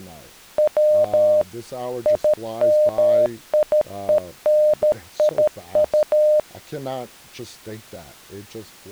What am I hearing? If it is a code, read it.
Morse code, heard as a keyed tone, machine-sent, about 13 wpm, 610 Hz, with speech in English. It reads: W IMIENIU